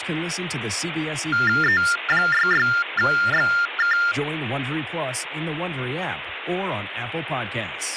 TTY/TDD text telephone tones (45.45 baud Baudot), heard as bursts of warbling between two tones, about 400 Hz shift, 1600 Hz centre, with phone line noise and speech in English. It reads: E66XK